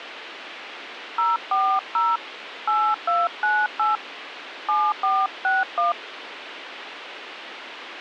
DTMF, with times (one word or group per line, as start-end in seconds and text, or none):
1.2-2.2 040
2.7-4.0 8298
4.7-5.9 7461